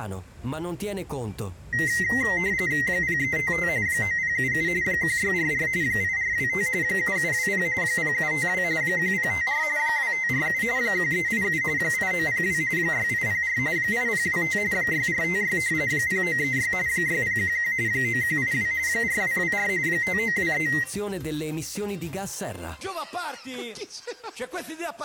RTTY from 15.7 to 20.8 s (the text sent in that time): 0936 6011 9182 4224 5923